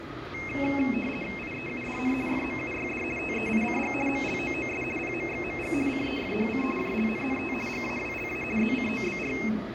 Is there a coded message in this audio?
Yes: RTTY (50 baud, 450 Hz shift) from 0.3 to 9.5 s, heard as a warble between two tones, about 2350 Hz centre, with radio static, room echo and the noise of a subway station. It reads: IEUDN FMUYD TEICG MLOOS PMXMG CEFHC JLNNT GAWLA ZCOBR